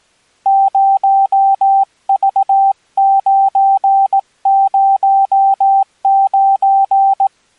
Morse code, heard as a keyed tone, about 18 wpm, 780 Hz. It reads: 0V909